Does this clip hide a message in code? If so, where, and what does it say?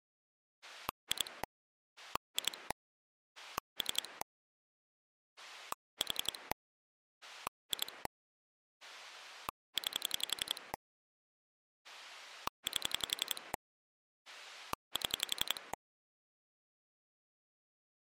Yes: pulse dialling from 0.6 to 15.7 s, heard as a rotary dial, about 11 pulses a second. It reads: 2 2 3 4 2 9 8 7